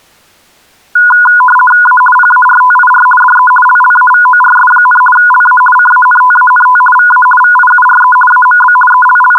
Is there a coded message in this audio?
Yes: RTTY (50 baud, 450 Hz shift) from 1.0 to 9.4 s, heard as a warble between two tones, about 1230 Hz centre. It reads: A PARTIR DE LLAVORS, LA CANTANT VA VIURE AMB …